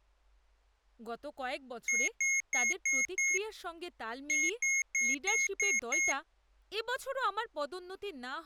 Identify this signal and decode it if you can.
Beep code, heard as beeps from a small speaker, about 2150 Hz, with speech in Bangla. 5-6.